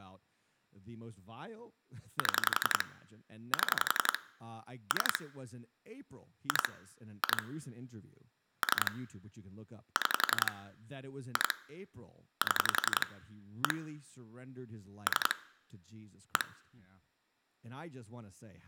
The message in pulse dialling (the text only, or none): 7 7 3 2 2 3 6 2 7 1 3 1